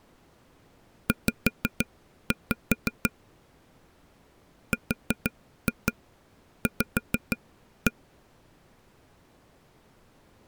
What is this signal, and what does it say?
Tap code, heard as taps on a table, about 6 knocks a second. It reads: Z RV